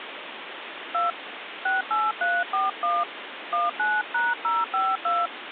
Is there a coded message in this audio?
Yes: DTMF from 0.9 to 5.3 s, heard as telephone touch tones, dialled by hand, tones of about 180 ms, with phone line noise. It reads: 2 68341 19#052